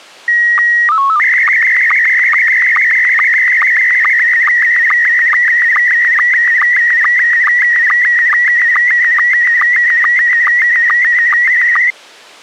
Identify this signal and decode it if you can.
SSTV (slow-scan television), Scottie S1, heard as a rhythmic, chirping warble.